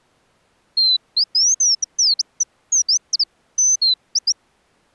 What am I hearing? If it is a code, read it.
Bird-like chirps. There is no code.